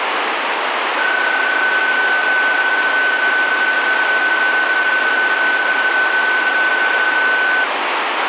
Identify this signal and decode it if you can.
PSK31 (31.25 baud), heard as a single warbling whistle, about 1500 Hz, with radio static.